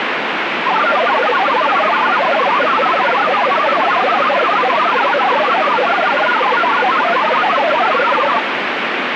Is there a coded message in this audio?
Yes: multi-tone FSK (Olivia or MFSK type), about 1000 Hz wide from 0.7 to 8.4 s, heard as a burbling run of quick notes, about 62.5 baud, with heavy radio static.